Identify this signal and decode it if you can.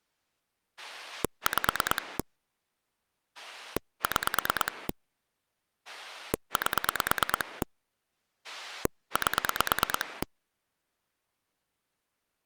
Pulse dialling, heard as a rotary dial, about 9 pulses a second. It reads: 5 6 8 8